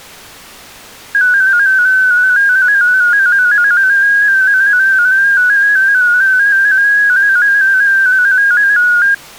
Multi-tone FSK (Olivia or MFSK type), about 250 Hz wide, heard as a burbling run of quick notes, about 15.625 baud.